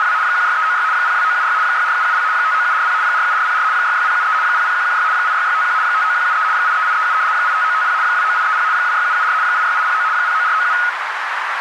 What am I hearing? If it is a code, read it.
RTTY (75 baud, 170 Hz shift), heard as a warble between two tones, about 1360 Hz centre, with radio static and a narrow filter. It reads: … 16396 02976 64770 59740 47404 66073 00116 86651 59173 83837 85950 29830 26774 86809 09497